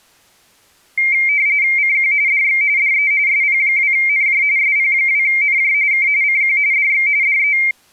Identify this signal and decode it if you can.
RTTY (45.45 baud, 170 Hz shift), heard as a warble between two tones, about 2200 Hz centre. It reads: CQ DX DE SP2NJ SP2NJ K CQ DX DE